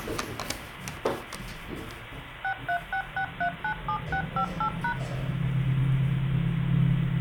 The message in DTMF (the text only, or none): 6366397658#